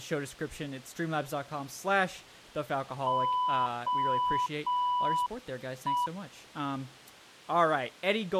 Morse code, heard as a keyed tone, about 6 wpm, 990 Hz, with speech in English. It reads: OE